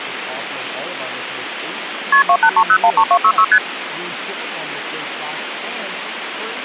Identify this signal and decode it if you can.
Multi-frequency trunk signalling (R1, as on North American trunks), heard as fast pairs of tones, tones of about 70 ms, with phone line noise and speech in English. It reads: KP 283013266 ST